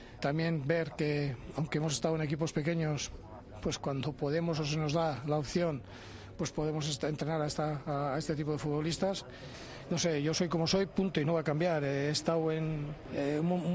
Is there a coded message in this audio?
No.